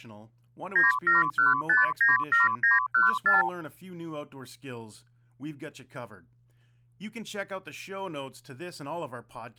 Multi-frequency trunk signalling (R2, with the far end's replies), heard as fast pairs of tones, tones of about 160 ms, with speech in English. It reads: 971597914